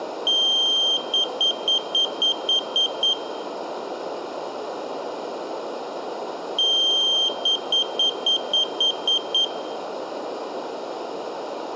Beep code, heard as a piezo beeper, played twice, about 3150 Hz, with room echo. 1 long, 8 short. In AMI BIOS tables: display or retrace test failure.